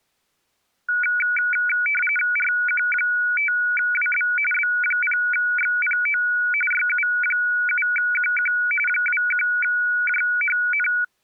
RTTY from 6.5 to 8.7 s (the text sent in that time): YU7QQ